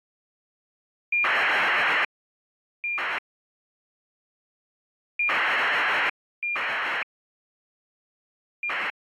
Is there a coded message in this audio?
Yes: ACARS aircraft data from 1.1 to 8.9 s, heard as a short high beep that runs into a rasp, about 2400 baud.